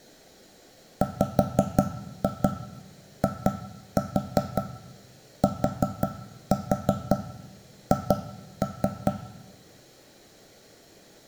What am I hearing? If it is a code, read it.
Tap code, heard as knocks on wood, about 5 knocks a second, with room echo. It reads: WITH